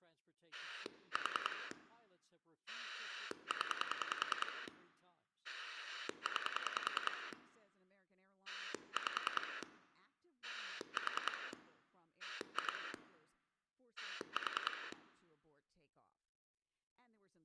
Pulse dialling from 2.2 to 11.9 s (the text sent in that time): 0 9 5 4